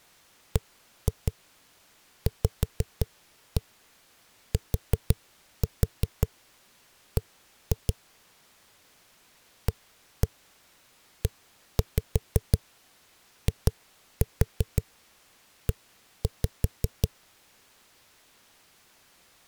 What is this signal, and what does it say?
Tap code, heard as knocks on a wall, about 5 knocks a second. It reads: BVTB AEIE